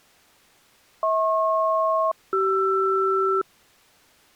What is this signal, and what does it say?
Aircraft SELCAL, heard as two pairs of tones. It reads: HP-CR